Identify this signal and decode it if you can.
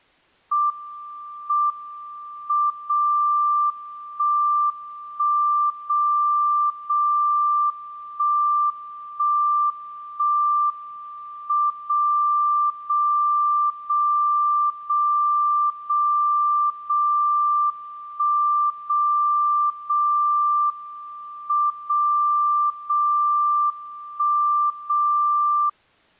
Radio time signal (WWVB), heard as a tone whose level steps once a second, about 1180 Hz. The time is 04:37 UTC. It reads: M M 0 1 1 0 0 1 1 1 M 0 0 0 0 0 0 1 0 0 M 0 0 1 0